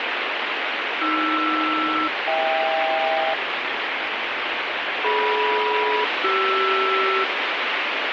Aircraft SELCAL, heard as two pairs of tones, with heavy radio static. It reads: AR-HK DM-CR